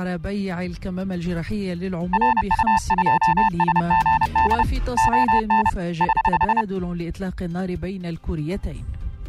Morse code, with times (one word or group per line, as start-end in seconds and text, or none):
2.1-4.6 RU2SGD
5.0-5.7 ON
6.0-6.6 <HH>